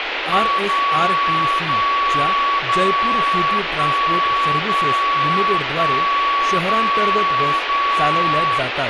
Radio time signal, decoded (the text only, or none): 0 0 0 1 0 1 0 0